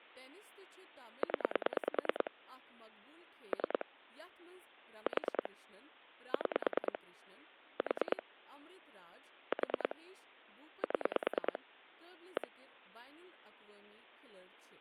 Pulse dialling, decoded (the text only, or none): 0 3 4 6 4 4 7 1